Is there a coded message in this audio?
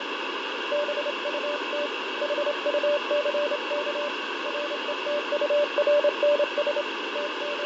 Yes: Morse code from 0.7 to 7.7 s, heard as a keyed tone, hand-sent with a straight key, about 28 wpm, 580 Hz, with heavy radio static and fading. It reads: BUT HUCK RETURNS …